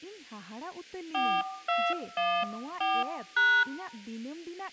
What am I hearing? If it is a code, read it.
DTMF, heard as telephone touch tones, dialled by hand, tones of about 220 ms, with speech in Santali. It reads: 4214#